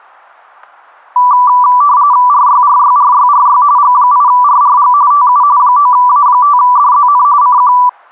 RTTY (45.45 baud, 170 Hz shift), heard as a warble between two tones, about 1080 Hz centre. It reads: RYRYRYRY G8RRG TU 9A5DZN CQ